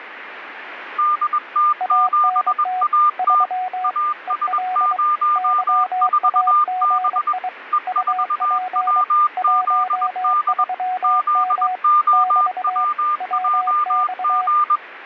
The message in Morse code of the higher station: DT7AT AS04B E4WZD ZOWJG

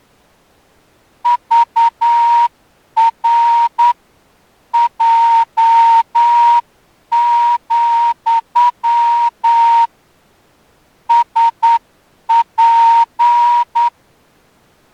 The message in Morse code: VR J, SP

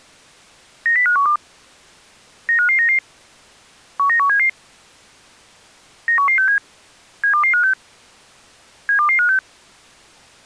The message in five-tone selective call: 90512 95599 19177 91167 72256 72256

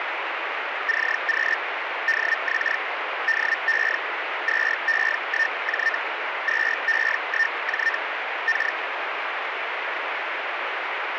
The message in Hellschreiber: CQ DX DE 2E1J 2E1J K

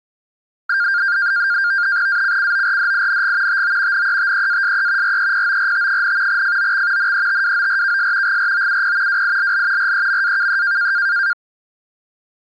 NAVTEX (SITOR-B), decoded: ACCORDING TO NETEASE REPORT, FOX NETWORKS GROUP WILL REMAKE

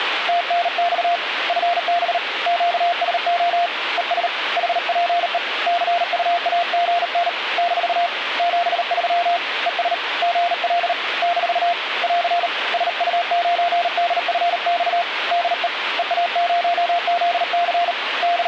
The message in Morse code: TNX FB QSO ES HPE CUAGN - 73 ES GL - <AR> SU9DFX DE EA0ZC …

